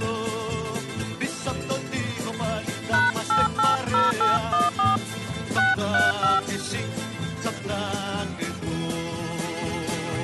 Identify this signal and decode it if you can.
DTMF, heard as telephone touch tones, dialled by hand, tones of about 170 ms. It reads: #880814 635